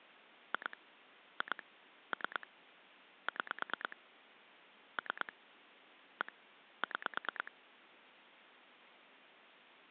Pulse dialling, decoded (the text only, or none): 2 2 3 6 3 1 6